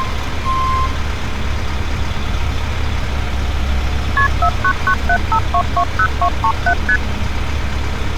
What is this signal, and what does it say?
Multi-frequency trunk signalling (R1, as on North American trunks), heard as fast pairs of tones, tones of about 70 ms, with street noise. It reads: KP 49975220237 ST